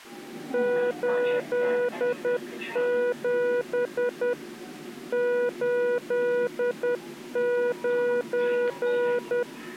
Morse code, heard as a keyed tone, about 10 wpm, 490 Hz, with the noise inside a subway train. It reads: 87 89